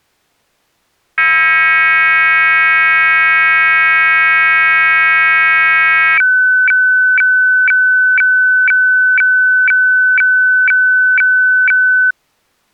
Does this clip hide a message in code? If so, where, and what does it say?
Yes: weather fax (radiofax), 120 lines a minute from 1.2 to 12.1 s, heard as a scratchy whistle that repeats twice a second.